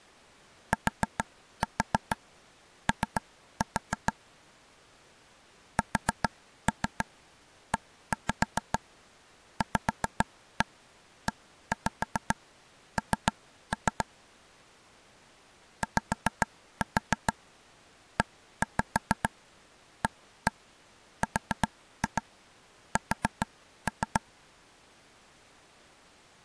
Tap code, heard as taps on a table, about 7 knocks a second. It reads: TO SEVEN YEARS